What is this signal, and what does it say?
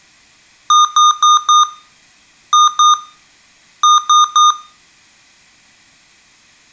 Beep code, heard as beeps from a small speaker, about 1220 Hz, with room echo. 4-2-3. In Phoenix BIOS tables: gate A20 failure.